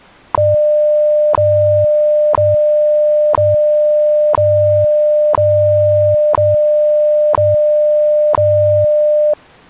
Radio time signal (WWV, Colorado), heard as ticks, one a second.